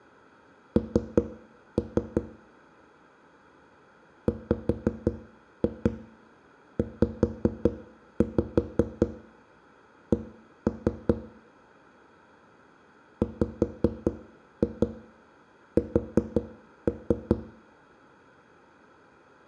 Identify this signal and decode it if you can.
Tap code, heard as knocks on a wall, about 5 knocks a second, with room echo. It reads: N WZC WS